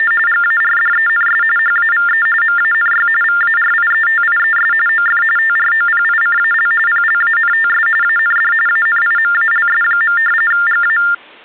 TTY/TDD text telephone tones (45.45 baud Baudot), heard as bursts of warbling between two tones, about 400 Hz shift, 1600 Hz centre. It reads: … GARDENS HAVE MANY VARIETIES OF TROPICAL PLANTS AND ANIMALS. GA